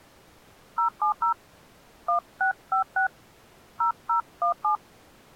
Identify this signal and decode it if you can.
DTMF, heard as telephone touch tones, dialled by hand, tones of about 110 ms. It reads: 070 1656 0017